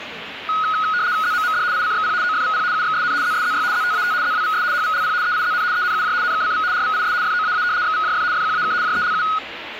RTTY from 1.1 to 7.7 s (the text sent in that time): ZMMD ICXP OFVP UXSN ZSZY ZTAT ZWVS HVLP EIZN ENUJ NKCV RVIS FOAA